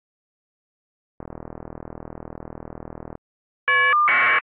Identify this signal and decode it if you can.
Caller ID data burst, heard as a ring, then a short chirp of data, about 1200 baud.